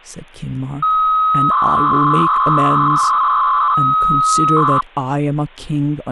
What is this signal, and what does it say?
300-baud modem data (Bell 103 tones), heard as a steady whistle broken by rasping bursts, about 300 baud, 200 Hz shift, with speech in English.